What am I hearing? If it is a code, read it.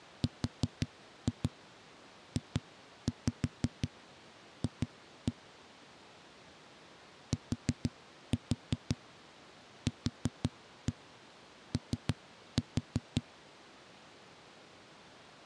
Tap code, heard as knocks on a wall, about 5 knocks a second. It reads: RJF TQO